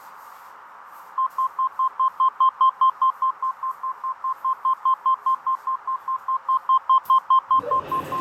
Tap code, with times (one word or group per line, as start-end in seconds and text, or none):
none